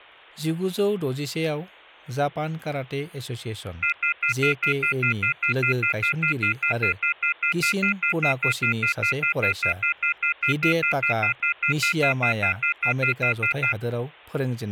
Telephone call progress tone (North American plan), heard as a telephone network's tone, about 1400, 2050, 2450, 2600 Hz, 0.1 s on and 0.1 s off, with speech in Bodo. Off-hook warning tone.